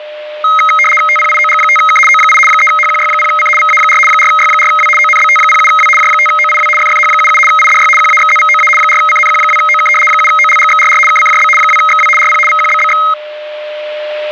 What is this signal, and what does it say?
RTTY (75 baud, 850 Hz shift), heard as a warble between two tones, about 1700 Hz centre, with a steady whistle near 600 Hz. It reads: TPIOG5K O8 3HQY0C VA4 4Y4W ONBT07W J5OIW FFH77 IDY QAXZVOA 4CNQ2OK 7OLGXRR KCJB 2XW RP VQBBX